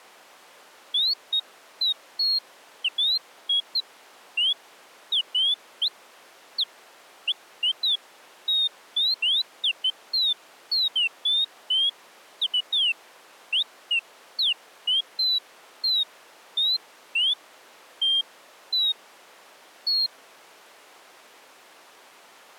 Bird-like chirps. There is no code.